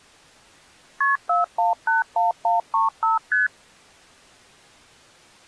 Multi-frequency trunk signalling (R1, as on North American trunks), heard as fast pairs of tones, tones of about 150 ms. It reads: KP 4181135 ST